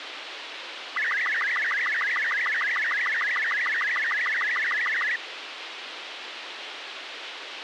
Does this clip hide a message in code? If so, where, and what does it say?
Yes: SSTV (slow-scan television), Robot 36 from 1.0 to 5.2 s, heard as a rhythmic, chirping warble, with radio hiss.